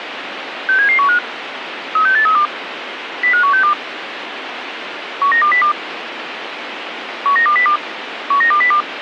Five-tone selective call (CCIR), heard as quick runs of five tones, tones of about 100 ms, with radio hiss. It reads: 67715 36832 05162 19202 19202 19202